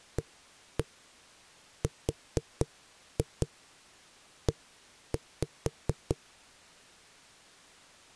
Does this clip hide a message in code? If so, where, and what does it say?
Yes: tap code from 0.2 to 6.2 s, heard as knocks on a wall, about 4 knocks a second. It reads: ARE